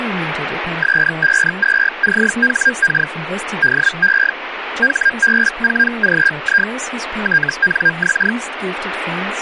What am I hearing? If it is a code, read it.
Hellschreiber (Feld-Hell, 122.5 baud), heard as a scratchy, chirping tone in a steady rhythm, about 1600 Hz, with radio static and speech in English. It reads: S52CHK DE HB4GI TNX